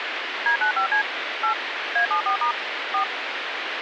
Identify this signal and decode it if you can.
DTMF, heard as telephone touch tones, dialled by machine, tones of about 100 ms, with phone line noise. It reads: D95C 8 A74* 4